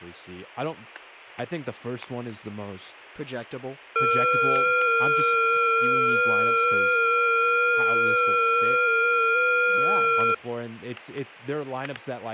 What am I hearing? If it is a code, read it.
FT8 (several signals at once), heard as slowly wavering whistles, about 6.25 baud, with static crashes and speech in English.